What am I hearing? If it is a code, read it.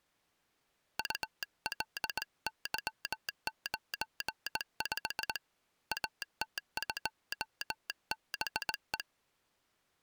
Morse code, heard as a telegraph sounder, hand-sent with a straight key, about 19 wpm. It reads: ULY95 AT2BE